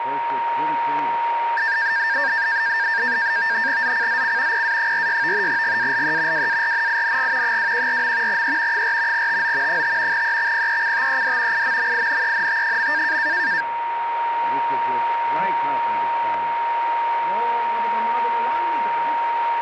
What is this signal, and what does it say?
NAVTEX (SITOR-B), 100 baud, 170 Hz shift, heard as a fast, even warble, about 1700 Hz centre, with radio static and a steady whistle near 930 Hz. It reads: ZCZC PA46 GALE WARNING 214. E 4 TO 5 EXPECTED IMMINENT.